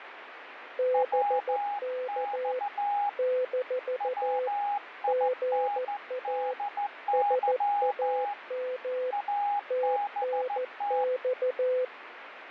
Morse code, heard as two keyed tones, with radio static. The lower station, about 14 wpm, 510 Hz: BK - GA SAM TNX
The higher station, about 14 wpm, 820 Hz: WX WINDY ABT